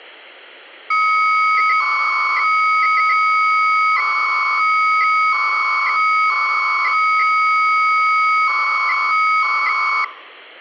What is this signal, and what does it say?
300-baud modem data (Bell 103 tones), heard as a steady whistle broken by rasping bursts, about 300 baud, 200 Hz shift.